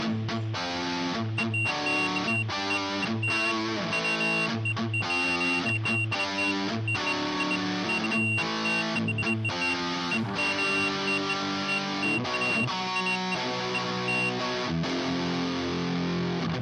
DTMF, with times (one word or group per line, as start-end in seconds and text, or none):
none